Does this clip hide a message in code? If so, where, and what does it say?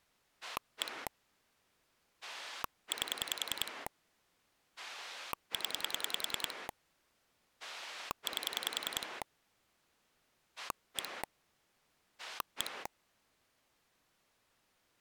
Yes: pulse dialling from 0.4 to 12.9 s, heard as a rotary dial, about 10 pulses a second. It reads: 1 8 0 8 1 1